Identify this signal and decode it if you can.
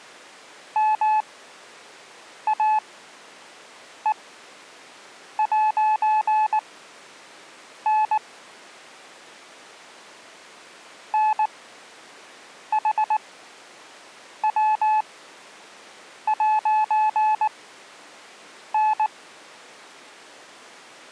Morse code, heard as a keyed tone, machine-sent, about 19 wpm, spaced as for 6 wpm, 860 Hz. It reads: MAE'N NHW'N